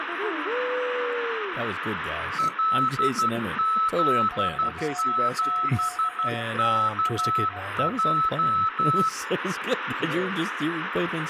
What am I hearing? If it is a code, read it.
Morse code, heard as two keyed tones, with radio static and speech in English. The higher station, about 12 wpm, 1300 Hz: LZ7KJ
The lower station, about 16 wpm, 720 Hz: CQ DE